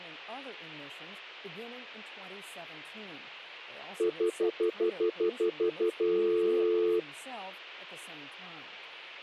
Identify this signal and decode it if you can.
Telephone call progress tone (North American plan), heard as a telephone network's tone, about 350, 440 Hz, 0.1 s on and 0.1 s off, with hum. Stutter dial tone.